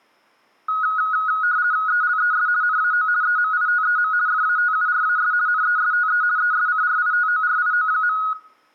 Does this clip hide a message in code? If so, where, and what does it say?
Yes: RTTY (50 baud, 170 Hz shift) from 0.7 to 8.3 s, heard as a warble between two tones, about 1360 Hz centre, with room echo. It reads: ELES NAO EMITEM FATURAS NESTE ESCRITORIO.